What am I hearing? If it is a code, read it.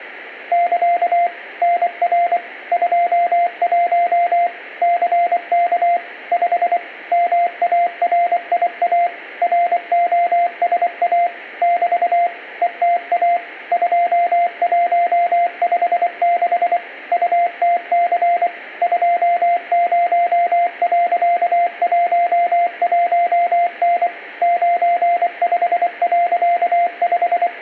Morse code, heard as a keyed tone, machine-sent, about 24 wpm, 690 Hz, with room echo. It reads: <KA> NR 21 CK 5 MARIA ROSA <BT> ETA 2156 UTC 20.11N …